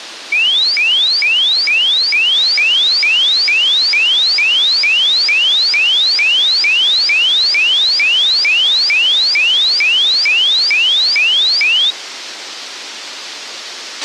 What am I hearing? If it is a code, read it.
A tone that sweeps in pitch again and again, with radio hiss and a squelch burst at the end. There is no code.